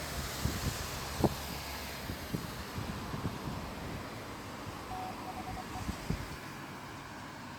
Morse code, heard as a keyed tone, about 24 wpm, 740 Hz, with street noise. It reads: THE